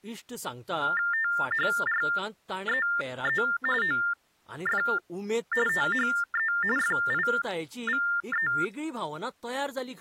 TTY/TDD text telephone tones (45.45 baud Baudot), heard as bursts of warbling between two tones, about 400 Hz shift, 1600 Hz centre, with speech in Goan Konkani. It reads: THREE OF THE FIVE